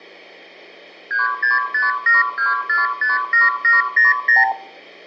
Multi-frequency trunk signalling (R2, with the far end's replies), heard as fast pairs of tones, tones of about 160 ms, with room echo. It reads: 36572457700